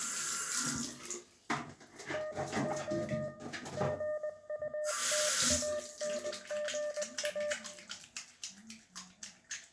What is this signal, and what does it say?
Morse code, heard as a keyed tone, hand-sent with a paddle, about 20 wpm, 600 Hz, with room echo and the noise of a restroom. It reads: NO GUTANGA